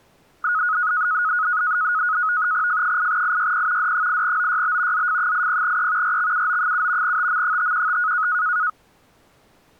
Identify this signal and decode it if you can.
NAVTEX (SITOR-B), 100 baud, 170 Hz shift, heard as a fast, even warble, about 1360 Hz centre. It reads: F8IYP D8OYB ZF80E RXUO7 TM515